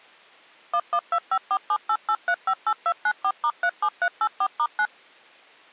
DTMF, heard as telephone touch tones, dialled by machine, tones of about 60 ms. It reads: 11254788358294*37384*9